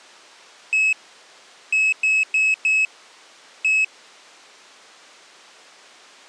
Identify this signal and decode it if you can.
Beep code, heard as a piezo beeper, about 2600 Hz. 1-4-1. In Phoenix BIOS tables: address line failure in the first 64 KB of memory.